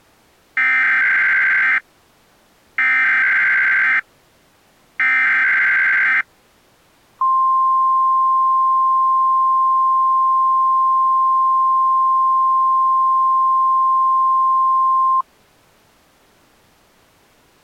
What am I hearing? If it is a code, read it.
Emergency Alert System (SAME) tones (header bursts, then the 1050 Hz attention tone), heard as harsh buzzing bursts, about 520.83 baud.